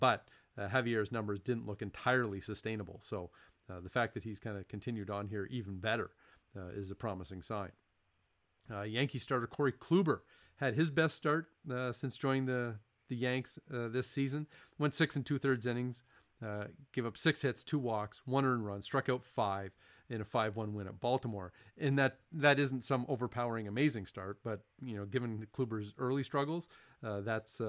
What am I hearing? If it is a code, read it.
Speech in English. There is no code.